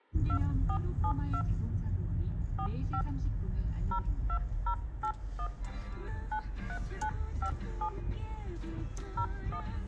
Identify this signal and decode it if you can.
DTMF, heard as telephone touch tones, dialled by hand, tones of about 80 ms, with the noise inside a car. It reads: 2472 45 02081 93957 01